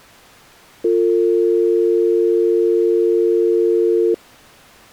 Telephone call progress tone (North American or UK plan), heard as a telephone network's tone, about 350, 450 Hz. Dial tone.